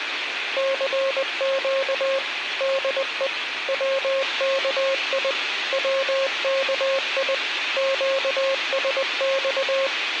Morse code, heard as a keyed tone, machine-sent, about 20 wpm, 540 Hz, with radio hiss. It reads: CQ DE WKI WKI QSX